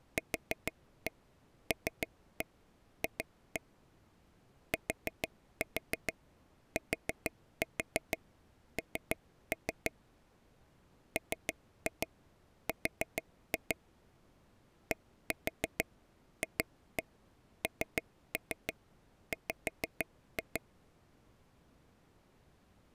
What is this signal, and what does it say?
Tap code, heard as taps on a table, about 6 knocks a second. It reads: QLF TTN MR DFNW